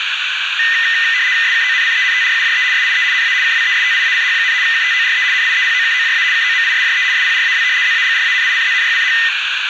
RTTY (75 baud, 170 Hz shift), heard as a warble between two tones, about 1900 Hz centre, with radio static, a narrow filter and room echo. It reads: SKONCENTRUJE SIE NA KWESTIACH, KTORE NIEPOKOJA KOMISJE SPRAW ZAGRANICZNYCH